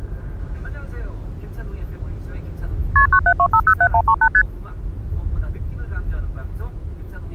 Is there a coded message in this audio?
Yes: multi-frequency trunk signalling (R1, as on North American trunks) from 3.0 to 4.4 s, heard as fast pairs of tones, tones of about 70 ms, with the noise inside a car. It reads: KP 972507138 ST